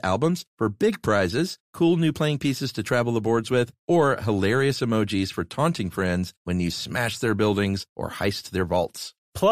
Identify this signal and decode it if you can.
Speech in English. There is no code.